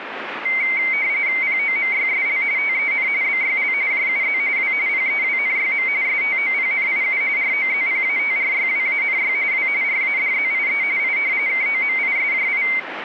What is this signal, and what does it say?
RTTY (45.45 baud, 170 Hz shift), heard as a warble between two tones, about 2150 Hz centre, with radio static. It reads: POMYSL TEN BYL JUZ W PEWNYM STOPNIU ROZPATRYWANY W RADZIE I KOMISJI